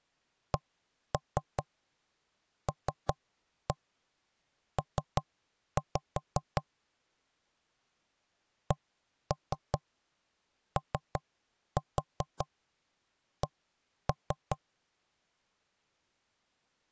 Tap code, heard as knocks on wood, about 5 knocks a second. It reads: CLP COC